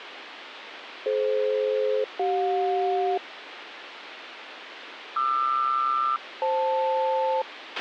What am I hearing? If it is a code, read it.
Aircraft SELCAL, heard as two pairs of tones, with radio hiss and a squelch burst at the end. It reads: DF-CJ QR-FL